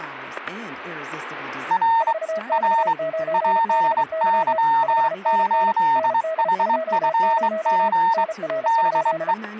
Morse code, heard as two keyed tones, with static crashes and speech in English. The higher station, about 23 wpm, 910 Hz: R R PY8HFG DE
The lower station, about 34 wpm, 640 Hz: 4X9BY 5NN ND20 NR?